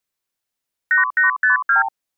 Multi-frequency trunk signalling (R2, with the far end's replies), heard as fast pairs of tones, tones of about 130 ms. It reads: 8852